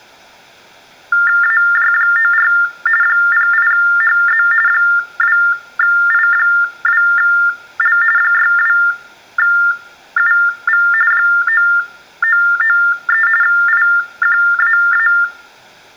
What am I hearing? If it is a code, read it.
TTY/TDD text telephone tones (45.45 baud Baudot), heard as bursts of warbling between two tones, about 400 Hz shift, 1600 Hz centre, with room echo. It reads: AJ94 08HZ 2I2L 62UV 9993 IQAA